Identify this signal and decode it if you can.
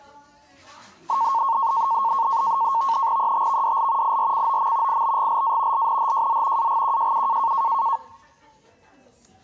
NAVTEX (SITOR-B), 100 baud, 170 Hz shift, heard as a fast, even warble, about 1000 Hz centre, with the noise of a restaurant. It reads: ETVDL IRCOM IBGLA LNHJZ AGQJU